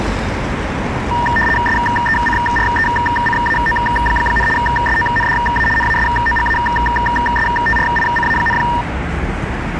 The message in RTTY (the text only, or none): SECRECAO, SONDA NASOGASTRICA,